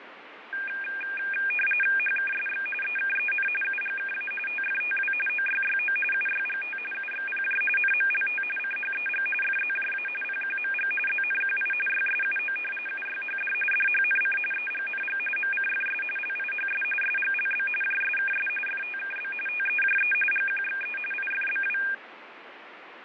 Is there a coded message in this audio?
Yes: RTTY (45.45 baud, 850 Hz shift) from 0.5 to 21.9 s, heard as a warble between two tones, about 2000 Hz centre, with radio static and fading. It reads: HKSX EKEN UGKA TFTW OYYO UYGT UXPJ NMLT CHEG FZJA PQMG ZNQI YSUO UYHD DHNC EGNG MCFS LIHS SGLB JSKS FTKB TEJE GQXE IFBW